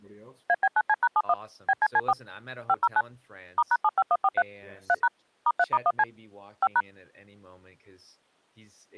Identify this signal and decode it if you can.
DTMF, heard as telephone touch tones, dialled by machine, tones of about 50 ms. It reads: AB9C#71 BCC4 509 *#75143 3# *3*1C 5#